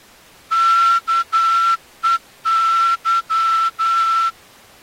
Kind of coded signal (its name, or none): Morse code